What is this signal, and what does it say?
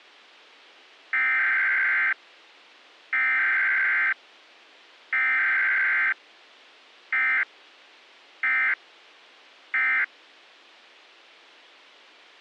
Emergency Alert System (SAME) tones (header bursts, then end-of-message bursts), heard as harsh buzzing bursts, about 520.83 baud, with a squelch burst at the end.